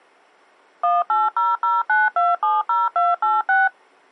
DTMF, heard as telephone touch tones, dialled by machine, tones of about 190 ms. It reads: 18009270286